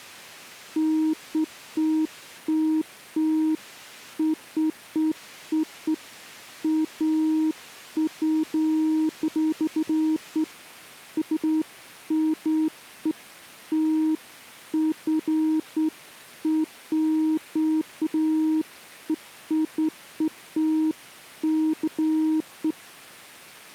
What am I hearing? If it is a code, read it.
Beeps of irregular length. There is no code.